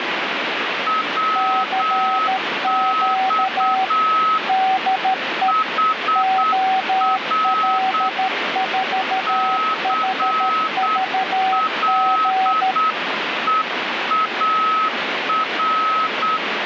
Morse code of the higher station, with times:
0.9-4.4 WX
5.5-8.1 HR
9.3-16.4 CLEAR

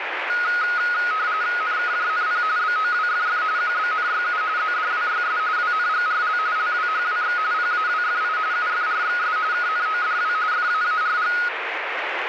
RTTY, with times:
1.6-2.4 NKJNP
2.6-3.4 BOWFF
3.6-4.4 QBNYU
4.6-5.4 ZDWYS
5.6-6.4 WNGRL
6.6-7.4 LWHWX
7.5-8.4 PAWFI
8.5-9.4 UFRXS
9.5-10.3 KNODW
10.5-11.3 FAARG

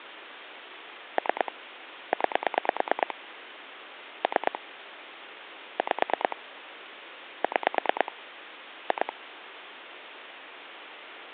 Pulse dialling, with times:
1.2-1.5 3
2.1-3.1 9
4.2-4.6 3
5.8-6.4 5
7.4-8.1 6
8.9-9.1 2

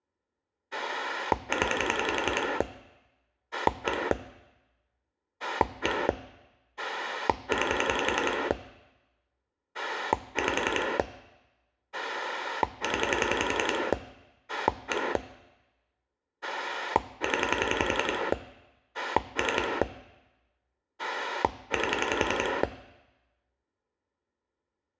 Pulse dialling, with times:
0.7-2.6 0
3.5-4.1 1
5.4-6.1 1
6.8-8.5 9
9.7-11.0 5
11.9-13.9 0
14.5-15.2 1
16.4-18.3 0
18.9-19.8 3
21.0-22.6 8

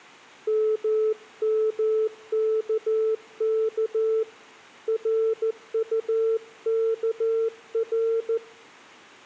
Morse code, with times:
0.5-4.2 MMKK
4.9-8.4 RUKR

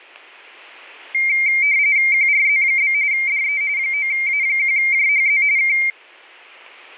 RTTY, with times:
2.1-2.9 QRZ?
3.1-3.6 DE
3.8-5.4 9A1JHZ
5.6-5.8 K

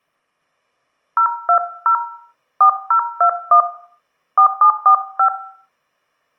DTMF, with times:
1.2-1.9 020
2.6-3.6 4021
4.4-5.3 4745

